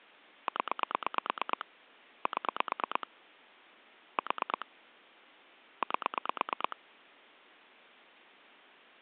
Pulse dialling, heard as clicks on a phone line, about 9 pulses a second. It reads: 0 7 4 8